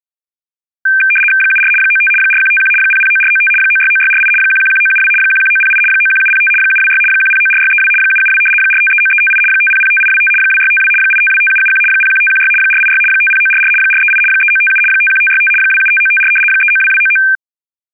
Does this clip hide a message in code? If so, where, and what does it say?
Yes: RTTY (75 baud, 850 Hz shift) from 0.9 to 17.4 s, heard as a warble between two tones, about 2000 Hz centre. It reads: 74 95 4151 009495 969648 111972 11908 91705 726 1094632 772 4539358 5005825 2652 8525771 01516 486 50944 438 3957 51565 275954 392299